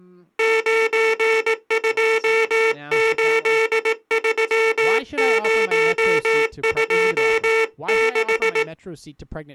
Morse code, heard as a buzzer, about 18 wpm, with speech in English. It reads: 9283026